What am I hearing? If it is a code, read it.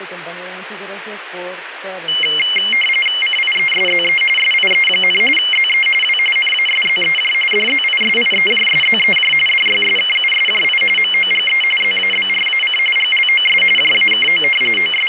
RTTY (45.45 baud, 850 Hz shift), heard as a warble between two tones, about 2550 Hz centre, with radio static and speech in Spanish. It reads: CIESZE SIE, ZE W NASZEJ DZISIEJSZEJ DYSKUSJI MOGE ZABRAC GLOS JAKO …